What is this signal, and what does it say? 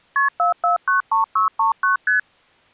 Multi-frequency trunk signalling (R1, as on North American trunks), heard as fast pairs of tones, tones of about 130 ms. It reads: KP 4493639 ST